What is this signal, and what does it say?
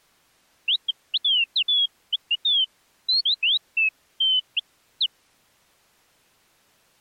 Bird-like chirps. There is no code.